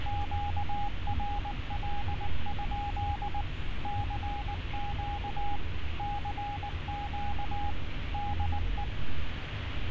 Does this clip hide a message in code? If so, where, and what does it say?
Yes: Morse code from 0.0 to 8.9 s, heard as a keyed tone, machine-sent, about 19 wpm, 820 Hz, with radio static and street noise. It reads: QRL? CQ CQ DE